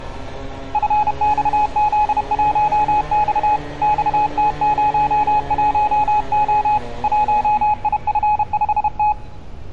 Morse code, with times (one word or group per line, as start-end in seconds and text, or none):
0.7-3.6 FXZ1X
3.8-6.8 XT01O
7.0-9.1 1IF5T